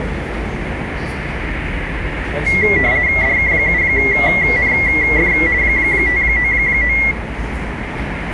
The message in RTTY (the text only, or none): DK7NF 599